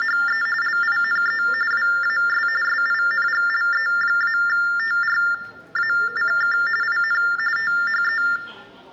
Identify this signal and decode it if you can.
TTY/TDD text telephone tones (45.45 baud Baudot), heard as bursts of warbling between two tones, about 400 Hz shift, 1600 Hz centre, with room echo and the noise of a subway station. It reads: … LINE WAS SINGLE-TRACK IN THE